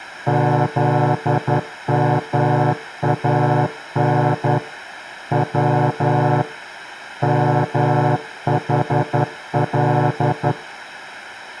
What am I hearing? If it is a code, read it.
Morse code (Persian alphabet), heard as a horn, hand-sent with a straight key, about 11 wpm. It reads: زمان و محل